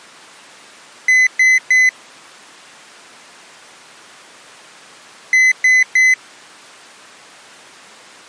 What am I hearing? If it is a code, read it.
Beep code, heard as a piezo beeper, played twice, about 2000 Hz. 3 short. In AMI BIOS tables: failure in the first 64 KB of memory; in Dell tables: chipset error.